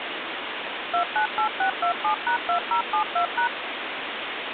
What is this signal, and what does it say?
DTMF, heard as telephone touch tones, dialled by machine, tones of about 100 ms, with phone line noise. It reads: 298627#2072#